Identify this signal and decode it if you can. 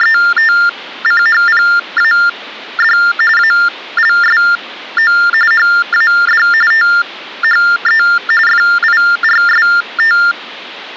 TTY/TDD text telephone tones (45.45 baud Baudot), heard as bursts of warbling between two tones, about 400 Hz shift, 1600 Hz centre. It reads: … ALSO HAD THE FIRST